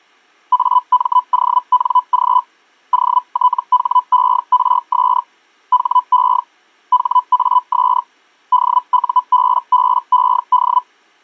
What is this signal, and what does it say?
Hellschreiber (Feld-Hell, 122.5 baud), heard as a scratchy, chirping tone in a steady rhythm, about 1000 Hz. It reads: AMONG OTHERS HE HAS DUBBED